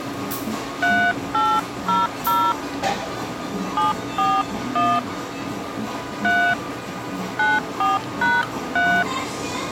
DTMF, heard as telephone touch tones, dialled by hand, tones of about 210 ms, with the noise of a cafe. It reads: 3800 741 3 94#3